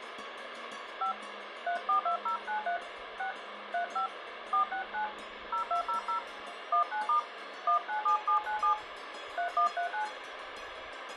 DTMF, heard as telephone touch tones, dialled by hand, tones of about 110 ms, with radio hiss. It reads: 5 342093 6 35 469 0200 19* 197797 3139